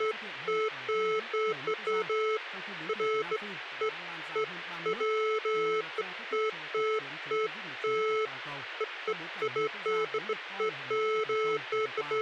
Beeps of irregular length, with radio hiss and speech in Vietnamese. There is no code.